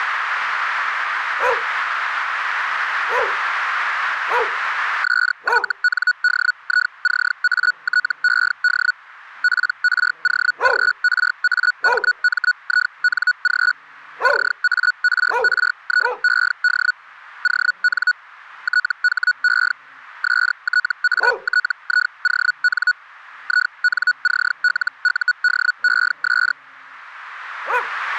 Hellschreiber (Feld-Hell, 122.5 baud), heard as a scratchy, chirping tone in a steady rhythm, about 1470 Hz. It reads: SYNDICATED PROGRAMMING CARRIED ON THE STATION INCLUDES